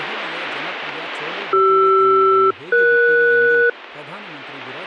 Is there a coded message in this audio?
Yes: aircraft SELCAL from 1.5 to 3.7 s, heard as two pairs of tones, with speech in Kannada. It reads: CR-ES